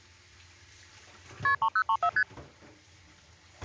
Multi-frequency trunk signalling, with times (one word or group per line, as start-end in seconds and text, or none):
1.4-1.5 KP
1.6-2.1 3034
2.2-2.2 ST